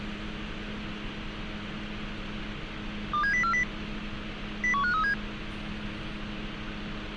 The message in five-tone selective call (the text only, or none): 27040 01537